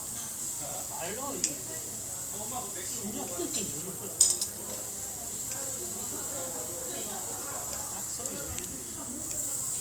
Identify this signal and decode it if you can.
The noise of a restaurant. There is no code.